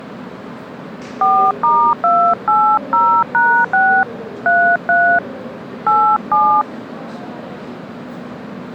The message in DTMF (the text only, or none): 4*280#6 33 87